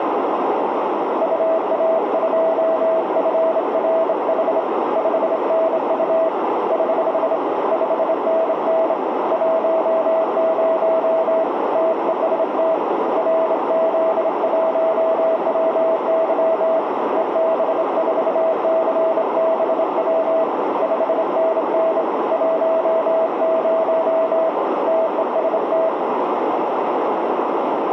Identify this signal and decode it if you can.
Morse code, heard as a keyed tone, hand-sent with a straight key, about 27 wpm, 650 Hz, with radio static and a narrow filter. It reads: UA2FRH 5NU <HH> 5NN 10 TEST RZ1WY EB4CBW 5NN 10 TEST